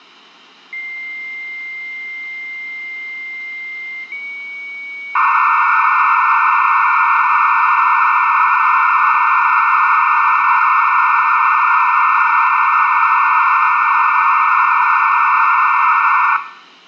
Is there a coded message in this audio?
Yes: dial-up modem handshake (low-speed, two carriers) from 0.7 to 16.4 s, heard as two whistles, then hiss, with room echo.